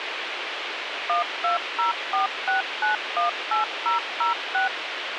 DTMF, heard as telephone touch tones, dialled by machine, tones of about 130 ms, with radio hiss. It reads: 12046918006